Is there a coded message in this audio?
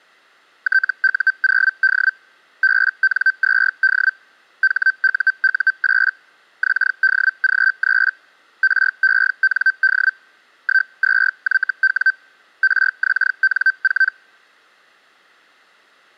Yes: Hellschreiber (Feld-Hell, 122.5 baud) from 0.6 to 14.1 s, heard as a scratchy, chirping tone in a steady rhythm, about 1550 Hz. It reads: TU0D BN2D HUU8 XDG3 REND 12YW RXN4